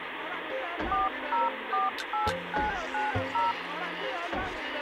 DTMF, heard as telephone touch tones, dialled by machine, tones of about 160 ms, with phone line noise. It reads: 4048990